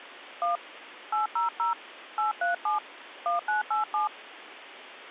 DTMF, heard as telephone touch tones, dialled by hand, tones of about 140 ms, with phone line noise. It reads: 1 800 837 1987